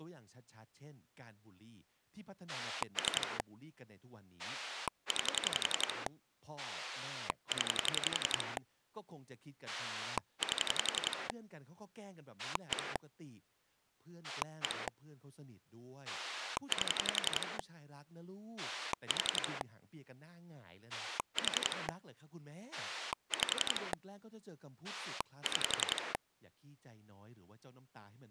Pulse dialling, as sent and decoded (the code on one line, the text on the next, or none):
3 / 9 / 10 / 8 / 1 / 1 / 8 / 4 / 4 / 5 / 6
3 9 0 8 1 1 8 4 4 5 6